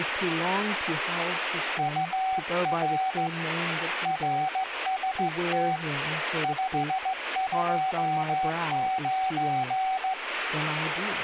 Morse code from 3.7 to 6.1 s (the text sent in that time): RST